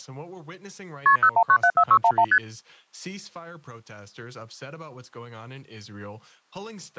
Multi-frequency trunk signalling (R1, as on North American trunks), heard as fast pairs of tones, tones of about 70 ms, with speech in English. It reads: KP 01974611 ST